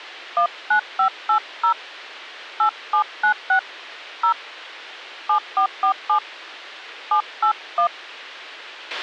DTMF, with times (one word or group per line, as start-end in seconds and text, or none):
0.4-1.7 19580
2.6-3.6 8796
4.2-4.3 0
5.3-6.2 7447
7.1-7.9 781